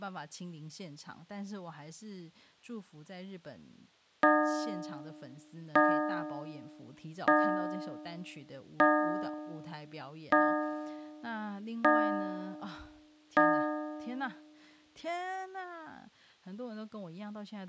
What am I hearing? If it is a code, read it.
Clock strike, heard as a bell, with speech in Chinese. 7. Seven o'clock.